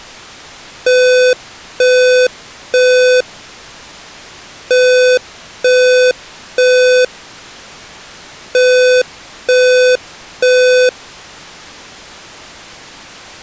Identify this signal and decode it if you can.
Alarm pattern, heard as an alarm's beeps, played three times, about 500 Hz. Temporal three. Smoke or fire, evacuate.